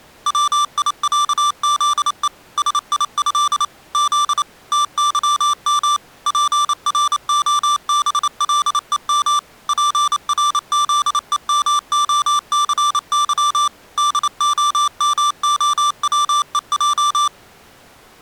Morse code (with Polish letters), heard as electronic beeps, machine-sent, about 28 wpm, 1180 Hz. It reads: WIĄZE SIĘ Z TYM PROBLEM PRZEMOCY DOMOWEJ